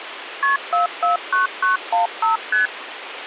Multi-frequency trunk signalling (R1, as on North American trunks), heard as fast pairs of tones, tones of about 130 ms, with phone line noise. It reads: KP 449915 ST